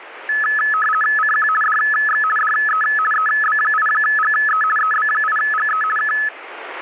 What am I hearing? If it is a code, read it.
RTTY (50 baud, 450 Hz shift), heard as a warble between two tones, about 1500 Hz centre, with radio static. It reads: CQ DX DE EB8GE EB8GE K